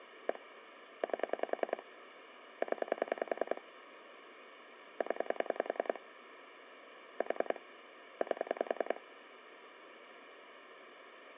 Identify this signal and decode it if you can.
Pulse dialling, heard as clicks on a phone line, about 10 pulses a second, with phone line noise. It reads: 1 8 0 0 4 8